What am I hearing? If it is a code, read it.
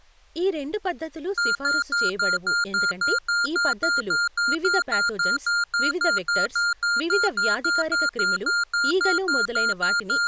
Evenly repeated beeps, with speech in Telugu. There is no code.